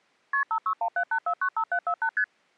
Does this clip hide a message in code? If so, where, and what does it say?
Yes: multi-frequency trunk signalling (R1, as on North American trunks) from 0.3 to 2.2 s, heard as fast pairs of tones, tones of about 80 ms. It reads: KP 56178495748 ST